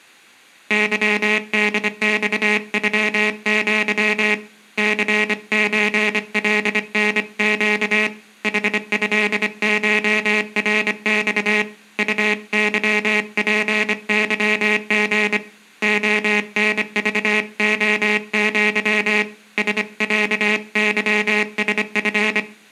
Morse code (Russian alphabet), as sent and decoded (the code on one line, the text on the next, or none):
-.-- -.. -..- ..-- --.-- / -.-. ---. .-.. -. --.- / .... ..-.. ---- .-. -..- / ..- -.-- .--. -.-- --. / --- -. ...- --- --.-- / ... .-.- -.-- ... ..-.
ЫДЬЮЪ ЦЧЛНЩ ХЭШРЬ УЫПЫГ ОНЖОЪ СЯЫСФ